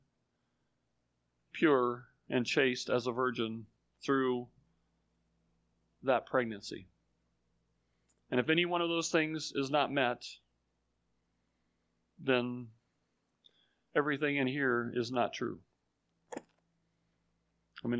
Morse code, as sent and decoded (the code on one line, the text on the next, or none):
none